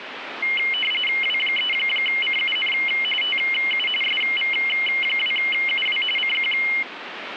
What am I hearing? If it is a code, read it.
RTTY (45.45 baud, 850 Hz shift), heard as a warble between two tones, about 2550 Hz centre, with radio static. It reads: W3CUN TU SV2UW CQ